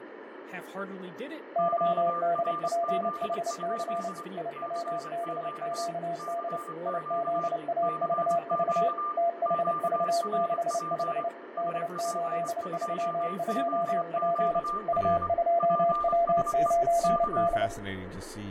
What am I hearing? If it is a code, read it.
Morse code, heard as two keyed tones, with radio static, fading and speech in English. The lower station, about 29 wpm, 680 Hz: YDPHC IWBQD IZAVV THV65 D832P U2W9D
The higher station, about 25 wpm, 1190 Hz: QRZ? CQ CQ CQ QRP SP2ZQR PSE K